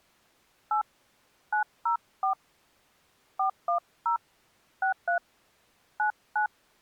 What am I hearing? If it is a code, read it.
DTMF, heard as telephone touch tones, dialled by hand, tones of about 110 ms. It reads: 8 904 410 63 99